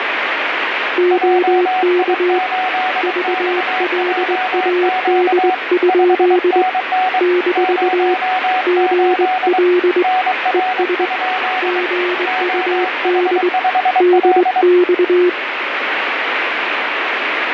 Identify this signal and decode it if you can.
Morse code, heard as two keyed tones, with radio static. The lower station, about 21 wpm, 360 Hz: OK VLAD? - GL ES GUD DX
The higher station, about 23 wpm, 740 Hz: JI8XJQ 5NN 08 NR? OH5L